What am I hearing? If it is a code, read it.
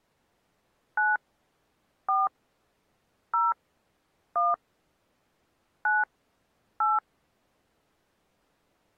DTMF, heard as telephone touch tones, dialled by hand, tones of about 190 ms. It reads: 9 4 0 1 9 8